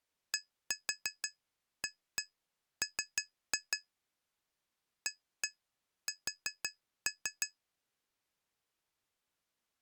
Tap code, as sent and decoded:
1-4 1-1 3-2 / 1-1 4-3
DAM AS

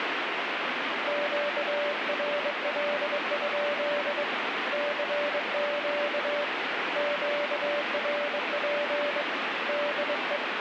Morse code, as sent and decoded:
--.- .-. .-.. ..--.. / -.-. --.- / --.- .-. .--. / -.. .
QRL? CQ QRP DE

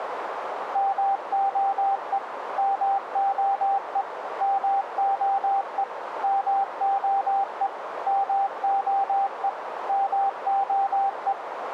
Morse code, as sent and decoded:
-- --- . / -- --- . / -- --- . / -- --- . / -- --- . / -- --- .
MOE MOE MOE MOE MOE MOE

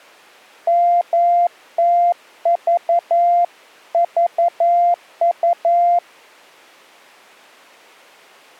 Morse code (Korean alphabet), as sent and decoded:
-- - ...- ...- ..-
멀리

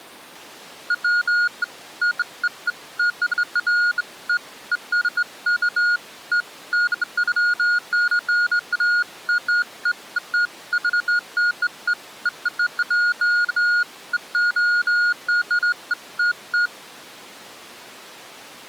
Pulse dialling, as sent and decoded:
none

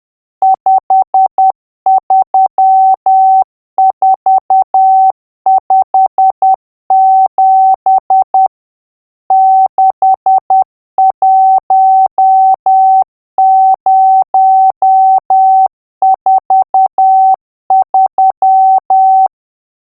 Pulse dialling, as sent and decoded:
none

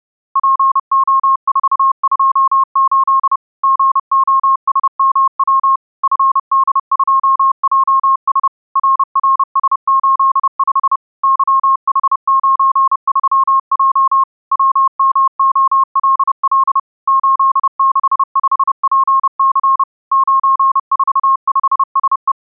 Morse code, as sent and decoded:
.--. --- ....- ..--- ---.. / --. --- ... -- .-- / ..-. -.. ..--- .--- ... / .-. .-. ... ---.. ..... / -.-- .... ----. ...-- .--- / .-- -- --- .-.. .-.. / ---.. -.... ..... .--. -.-. / ----. ....- ..... ... .
PO428 GOSMW FD2JS RRS85 YH93J WMOLL 865PC 945SE

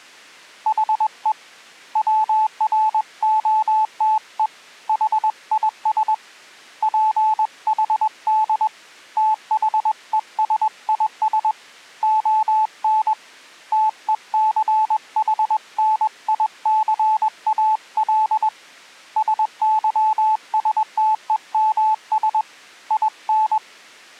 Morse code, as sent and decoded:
.... . / .-- .-. --- - . / .... .. ... / .--. .... -.. / - .... . ... .. ... / --- -. / - . -.-. .... -. .. -.-. .- .-.. / ... -.-- ... - . -- ... / .. -.
HE WROTE HIS PHD THESIS ON TECHNICAL SYSTEMS IN

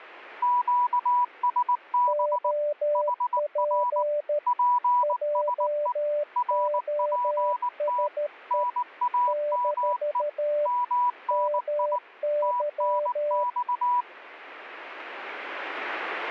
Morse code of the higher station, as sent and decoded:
--.- ... -... / .... .-. / .--. ... . / .-. .--. - / -. .- -- . / -- -. .. / - -. -..-
QSB HR PSE RPT NAME MNI TNX

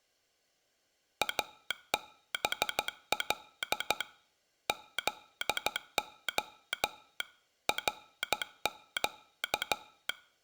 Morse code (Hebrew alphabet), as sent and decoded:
.- -... .-.. / --.. --- / .-. --.-
אבל זה רק

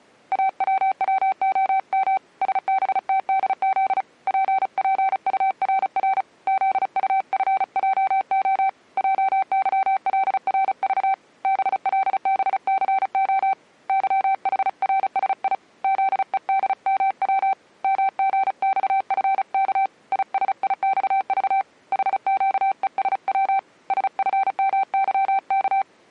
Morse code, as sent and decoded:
.- .-- .-- --- -- / ... -... - -.. --.. / .--. .--. ..- .-. .-. / --.. ..- ..-. .--- --- / .--- -.-- .-.. .-. ...- / -... .-.. -... -.-. --- / -.-- .... .-. ... .. / --.. . -.. -- .-- / -- --. -..- ..-. -.- / .. ... .. -..- ...- / .... --.- . ... .-- / ... ..-. -- -.-- -.-
AWWOM SBTDZ PPURR ZUFJO JYLRV BLBCO YHRSI ZEDMW MGXFK ISIXV HQESW SFMYK

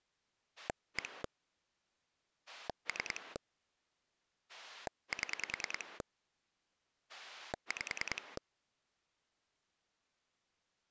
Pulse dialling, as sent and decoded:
1 / 3 / 7 / 5
1 3 7 5

